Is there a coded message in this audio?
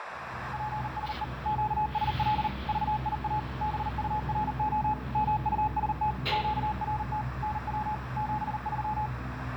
Yes: Morse code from 0.5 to 9.1 s, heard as a keyed tone, machine-sent, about 39 wpm, 850 Hz, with radio static, a narrow filter and the noise inside a lift. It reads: PSE QSL VIA BURO MUST QRT NW 73